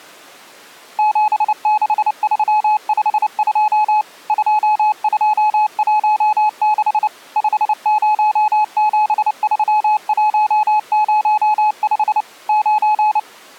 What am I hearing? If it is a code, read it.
Morse code, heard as a keyed tone, machine-sent, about 29 wpm, 850 Hz. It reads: 76352 2216 5073105 9